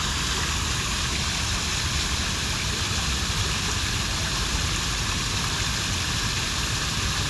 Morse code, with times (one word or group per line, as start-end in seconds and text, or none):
none